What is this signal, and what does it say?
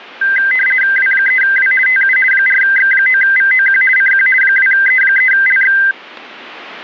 RTTY (50 baud, 450 Hz shift), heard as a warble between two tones, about 1800 Hz centre. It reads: W3W TU 4X9VOQ CQ 2E3LX